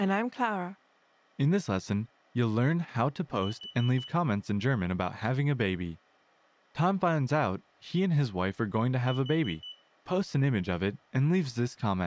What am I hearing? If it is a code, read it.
Alarm pattern, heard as an alarm's beeps, played twice, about 3000 Hz, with room echo and speech in English. Temporal four. Carbon monoxide.